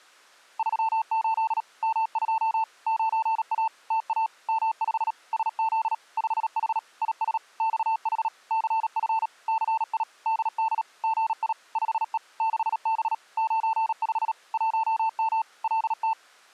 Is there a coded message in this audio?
Yes: Morse code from 0.5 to 16.2 s, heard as a keyed tone, machine-sent, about 37 wpm, 890 Hz. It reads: 38 M2 9A TA M5 SZ 5H IS XH CF CI DD GI 5E 6B 95 1M LT